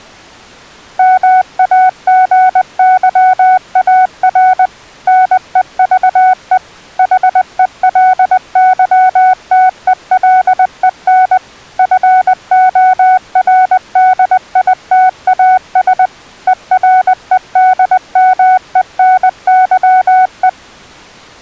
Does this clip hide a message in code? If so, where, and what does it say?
Yes: Morse code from 0.9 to 20.6 s, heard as a keyed tone, machine-sent, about 20 wpm, 740 Hz. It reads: MAGYAR NEVE HELYTELEN FORDITAS EREDMENYE